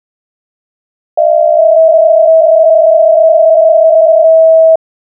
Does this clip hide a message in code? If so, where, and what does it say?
Yes: PSK63 (62.5 baud) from 1.2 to 4.8 s, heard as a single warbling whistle, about 650 Hz.